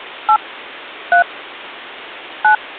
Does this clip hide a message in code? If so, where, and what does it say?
Yes: DTMF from 0.3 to 2.6 s, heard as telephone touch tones, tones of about 80 ms. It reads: 8 3 9